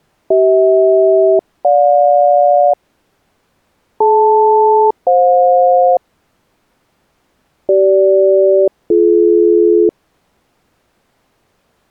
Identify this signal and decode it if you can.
Aircraft SELCAL, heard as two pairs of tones. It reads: CH-GJ DL-FJ CG-BD